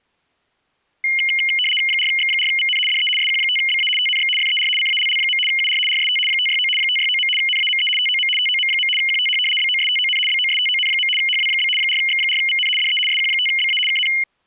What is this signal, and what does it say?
RTTY (75 baud, 850 Hz shift), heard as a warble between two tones, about 2550 Hz centre. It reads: 4X4VN DE SQ5BA TNX FER CALL. UR RST 569 569. NAME TOM TOM. QTH BOSTON BOSTON. HW? 4X4VN DE SQ5BA KN